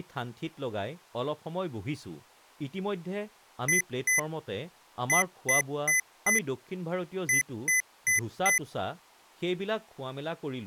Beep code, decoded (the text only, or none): 2-4-4